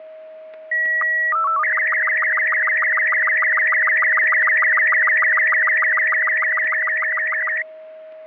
SSTV (slow-scan television), Robot 36, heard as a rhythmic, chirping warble, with static crashes and a steady whistle near 630 Hz.